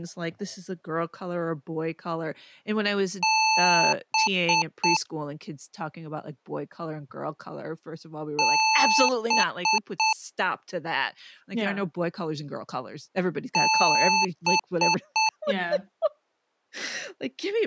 Beep code, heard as beeps from a small speaker, played three times, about 880 Hz, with speech in English. 1 long, 3 short. In Award and IBM BIOS tables: video adapter failure; in AMI BIOS tables: memory failure.